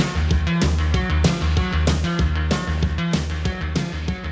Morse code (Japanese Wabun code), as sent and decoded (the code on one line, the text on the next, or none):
none